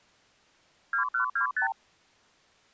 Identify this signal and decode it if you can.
Multi-frequency trunk signalling (R2, with the far end's replies), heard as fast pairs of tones, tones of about 110 ms. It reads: 2125